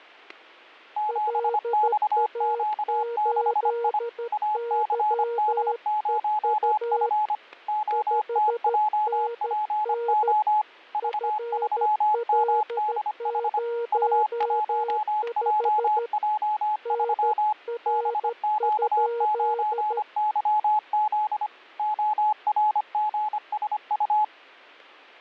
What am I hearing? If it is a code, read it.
Morse code, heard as two keyed tones, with static crashes. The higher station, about 25 wpm, 850 Hz: 7XQ6I ACD0F OTJPO V3MDH U1JJ3 BQ9YZ ORGSU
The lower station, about 13 wpm, 470 Hz: LA8YEU 5NN FL05 NR?